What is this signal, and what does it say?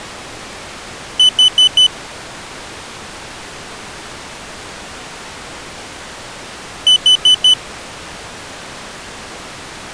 Alarm pattern, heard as an alarm's beeps, played twice, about 3000 Hz. Temporal four. Carbon monoxide.